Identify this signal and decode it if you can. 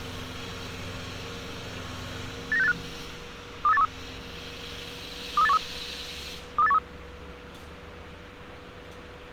Five-tone selective call (EEA), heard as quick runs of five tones, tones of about 40 ms, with street noise. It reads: 89685 23813 23813 23813